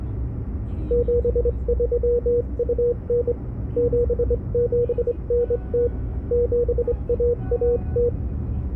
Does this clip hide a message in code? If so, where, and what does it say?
Yes: Morse code (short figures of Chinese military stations) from 0.8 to 8.1 s, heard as a keyed tone, hand-sent with a straight key, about 24 wpm, 480 Hz, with the noise inside a car. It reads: 7329 7790 7110